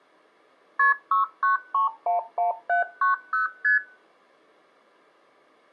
Multi-frequency trunk signalling (R1, as on North American trunks), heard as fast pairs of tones, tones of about 130 ms. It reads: KP 69311790 ST